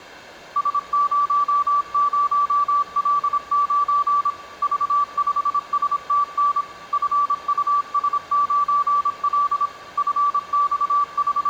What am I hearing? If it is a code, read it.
Morse code, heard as a keyed tone, machine-sent, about 26 wpm, 1160 Hz, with room echo. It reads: S00L9 V5STN FUS9L …